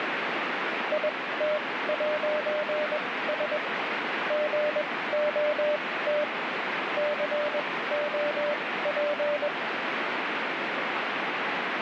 Morse code, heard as a keyed tone, machine-sent, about 21 wpm, spaced as for 16 wpm, 600 Hz, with heavy radio static. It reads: IT'S GOT COP